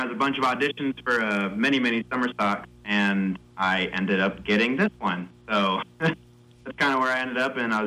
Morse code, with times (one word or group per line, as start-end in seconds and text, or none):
none